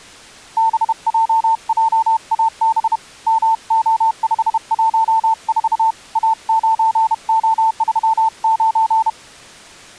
Morse code, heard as a keyed tone, hand-sent with a bug key, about 31 wpm, 890 Hz. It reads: BJJAB MO514 A9O39